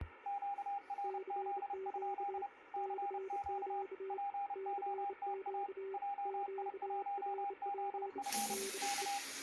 Morse code, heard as two keyed tones, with radio static. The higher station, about 30 wpm, 800 Hz: QRZ? CQ POTA JI1ZF K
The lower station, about 28 wpm, 390 Hz: CQ CQ CQ QRP DE